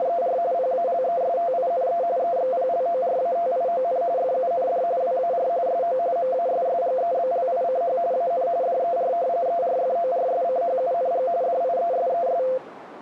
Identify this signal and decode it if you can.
RTTY (45.45 baud, 170 Hz shift), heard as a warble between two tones, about 600 Hz centre, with radio static. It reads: … PALESTINE EXPLORATION FUND WAR SO MASSGEBLICH AN DER ERFORSCHUNG DIESES